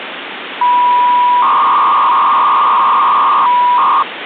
300-baud modem data (V.21 tones), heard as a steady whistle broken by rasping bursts, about 300 baud, 200 Hz shift, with phone line noise.